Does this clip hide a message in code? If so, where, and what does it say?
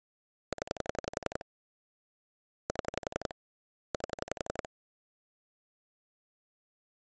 Yes: pulse dialling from 0.5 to 4.7 s, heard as clicks on a phone line, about 11 pulses a second. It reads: 0 7 8